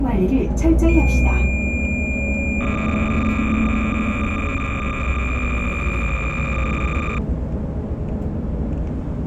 Cassette data (Kansas City type), 300 baud, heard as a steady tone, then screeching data, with the noise inside a bus.